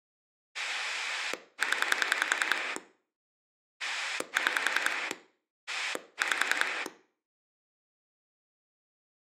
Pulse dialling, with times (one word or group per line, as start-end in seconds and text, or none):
0.5-2.8 0
3.8-5.1 6
5.7-6.9 5